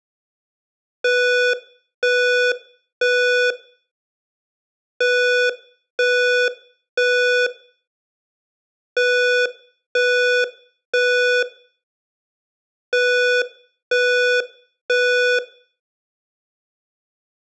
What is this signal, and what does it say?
Alarm pattern, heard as an alarm's beeps, played four times, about 490 Hz, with room echo. Temporal three. Smoke or fire, evacuate.